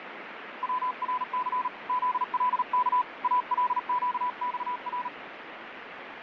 Morse code (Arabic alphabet), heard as a keyed tone, hand-sent with a paddle, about 38 wpm, 1000 Hz, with radio static and fading. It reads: ورث ذلك القصر